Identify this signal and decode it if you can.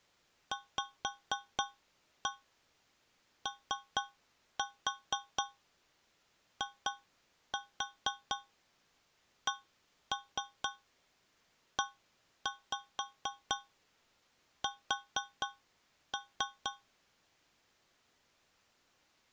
Tap code, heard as taps on a metal pipe, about 4 knocks a second. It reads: VOICES